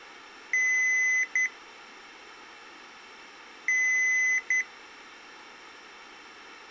Beep code, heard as beeps from a small speaker, played twice, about 2000 Hz. 1 long, 1 short. In IBM BIOS tables: system board problem.